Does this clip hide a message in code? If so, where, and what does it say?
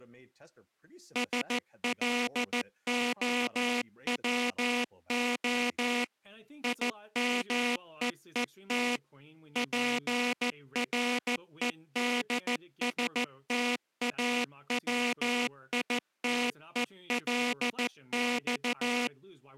Yes: Morse code (Russian alphabet) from 1.1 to 19.1 s, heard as a buzzer, machine-sent, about 14 wpm, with speech in English. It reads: СЛОВО ИМЕЕТ ПРЕДСТАВИТЕЛЬ